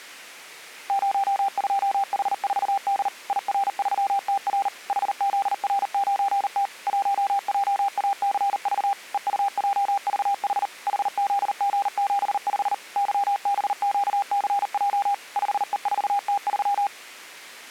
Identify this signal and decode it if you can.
Morse code, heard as a keyed tone, machine-sent, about 39 wpm, 800 Hz. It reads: 02H4D IR3TR HZR9T 1JACV EUJVH HZG75 YBQCJ 5E4T3